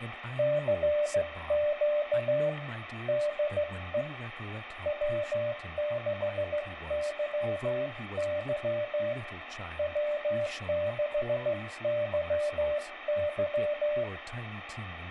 Morse code, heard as a keyed tone, hand-sent with a straight key, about 15 wpm, 590 Hz, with radio static and speech in English. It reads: CQ DE W6YY W6YY